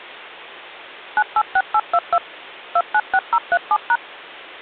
DTMF, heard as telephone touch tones, dialled by machine, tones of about 60 ms. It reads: 986822 296037#